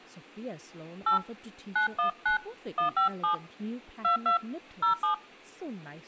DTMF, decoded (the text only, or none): 8 919 157 22 07